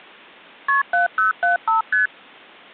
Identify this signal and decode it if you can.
Multi-frequency trunk signalling (R1, as on North American trunks), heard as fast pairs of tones, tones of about 130 ms. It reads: KP 7075 ST